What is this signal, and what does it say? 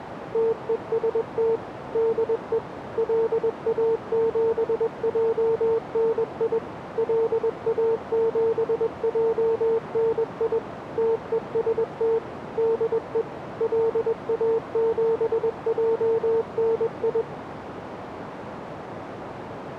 Morse code, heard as a keyed tone, machine-sent, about 21 wpm, 450 Hz, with radio static and a narrow filter. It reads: TEST DE LA7JNI LA7JNI TEST DE LA7JNI